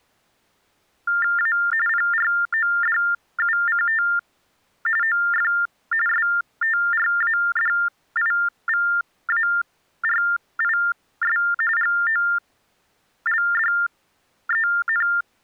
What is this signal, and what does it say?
TTY/TDD text telephone tones (45.45 baud Baudot), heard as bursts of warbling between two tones, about 400 Hz shift, 1600 Hz centre. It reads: A PRODUCT OF STRADIVARIS GOLDEN